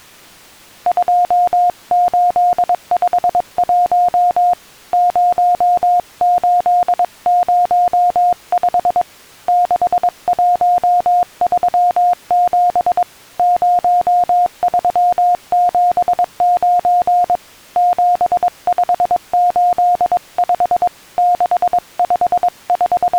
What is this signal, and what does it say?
Morse code, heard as a keyed tone, hand-sent with a paddle, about 22 wpm, 710 Hz. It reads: 2851 0805 6137 0379 7585 …